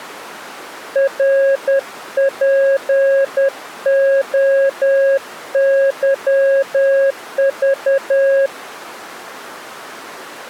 Morse code, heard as a keyed tone, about 10 wpm, 550 Hz. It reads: RPOYV